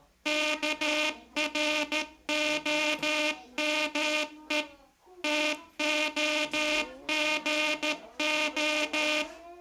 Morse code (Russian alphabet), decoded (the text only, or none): КРОМЕ ТОГО